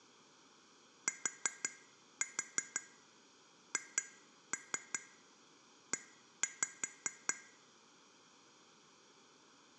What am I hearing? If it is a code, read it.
Tap code, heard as taps on glass, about 5 knocks a second. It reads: THE